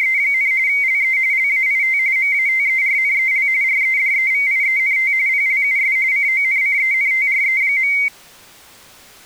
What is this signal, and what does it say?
RTTY (45.45 baud, 170 Hz shift), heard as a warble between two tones, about 2150 Hz centre. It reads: … LE LAIT MATERNEL REDEVIENT PLUS CONCENTRE.